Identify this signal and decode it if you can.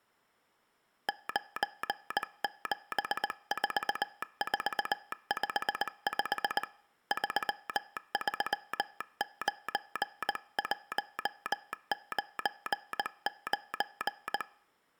Morse code, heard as a telegraph sounder, hand-sent with a paddle, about 19 wpm. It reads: 974455 339199